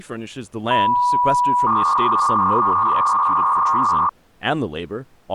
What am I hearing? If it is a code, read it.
300-baud modem data (V.21 tones), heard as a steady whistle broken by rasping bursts, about 300 baud, 200 Hz shift, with speech in English.